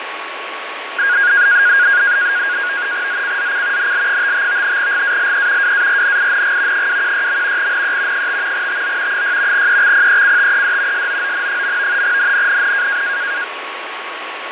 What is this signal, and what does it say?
NAVTEX (SITOR-B), 100 baud, 170 Hz shift, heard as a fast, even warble, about 1550 Hz centre, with radio static, fading and a steady whistle near 1110 Hz. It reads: ZCZC NL55 GALE WARNING 216. NE 5 TO 6 EXPECTED SOON. NNNN